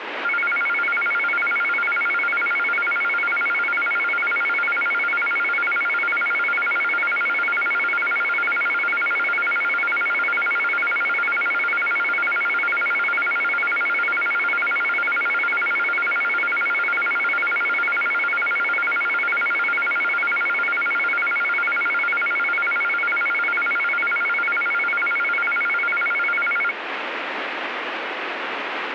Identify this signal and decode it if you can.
A tone that alternates evenly between two pitches, with radio static. There is no code.